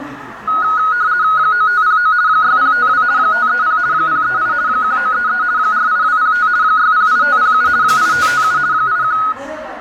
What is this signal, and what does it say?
RTTY (50 baud, 170 Hz shift), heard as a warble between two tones, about 1360 Hz centre, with radio static and the noise of a crowd indoors. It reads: 9509 6052 530 038 1933 48205 608507 8557 81